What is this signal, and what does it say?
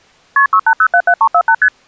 Multi-frequency trunk signalling (R1, as on North American trunks), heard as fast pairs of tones, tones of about 70 ms. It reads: KP 68077348 ST